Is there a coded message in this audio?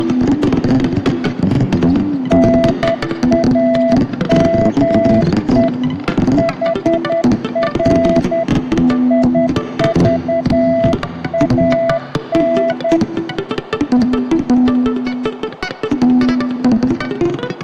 Yes: Morse code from 2.2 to 13.0 s, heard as a keyed tone, hand-sent with a paddle, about 10 wpm, 670 Hz, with radio static. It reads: NAME HR IVAN